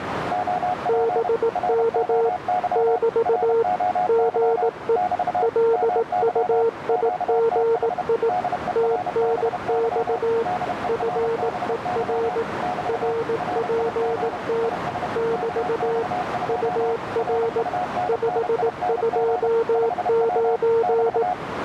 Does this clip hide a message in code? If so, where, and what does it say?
Yes: Morse code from 0.3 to 21.4 s, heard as two keyed tones, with radio static and a narrow filter. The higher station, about 31 wpm, 730 Hz: OP ROY ROY <BT> MY QTH DERBY DERBY <BT> RIG IS KX2 RUNNING 5W <BT>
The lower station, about 18 wpm, 460 Hz: BK <BT> GE LUIGI TNX FER RPT <BT> UR 529